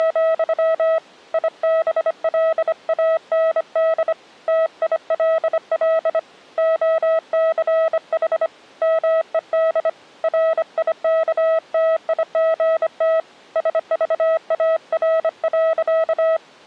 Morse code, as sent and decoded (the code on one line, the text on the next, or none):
… / .. -... .-.. .- -. -.. / - .. .-.. .-.. / --- -.-. .... / -- . -.. / .-. .. -.- - .. --. - / ... ...- .- .-. .-.-.-
… IBLAND TILL OCH MED RIKTIGT SVAR.